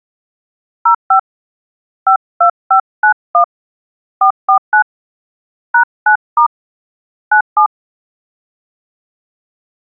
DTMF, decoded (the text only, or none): 05 52591 449 #9* 97